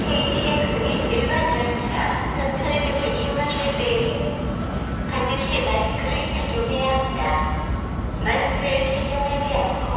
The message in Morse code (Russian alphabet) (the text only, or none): none